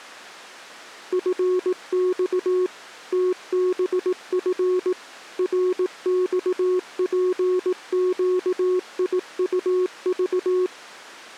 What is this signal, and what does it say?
Morse code, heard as a keyed tone, machine-sent, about 18 wpm, 370 Hz. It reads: FX TBF RXPQIUV